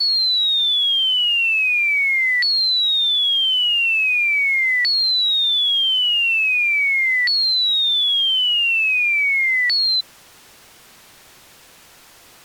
A tone that sweeps in pitch again and again. There is no code.